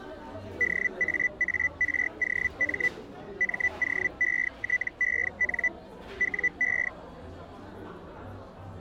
Hellschreiber (Feld-Hell, 122.5 baud), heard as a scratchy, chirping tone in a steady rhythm, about 2000 Hz, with the noise of a cafe. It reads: DAAROM MOETEN WE